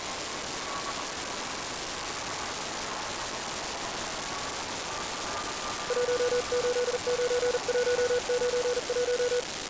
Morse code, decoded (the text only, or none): 189191